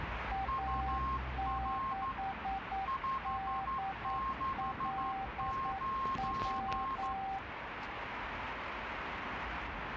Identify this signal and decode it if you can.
Morse code, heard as two keyed tones, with radio static and street noise. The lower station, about 9 wpm, 780 Hz: A6DLW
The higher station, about 12 wpm, 1070 Hz: UR 569